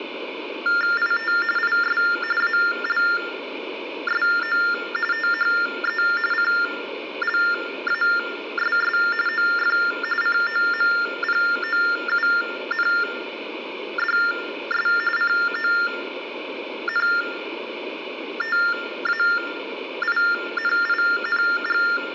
TTY/TDD text telephone tones (45.45 baud Baudot), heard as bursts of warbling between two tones, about 400 Hz shift, 1600 Hz centre, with room echo. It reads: IT IS ALSO THE CLASS OF COMPOUNDS CONTAINING